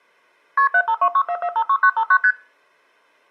Multi-frequency trunk signalling (R1, as on North American trunks), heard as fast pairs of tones, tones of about 70 ms. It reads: KP 75264456959 ST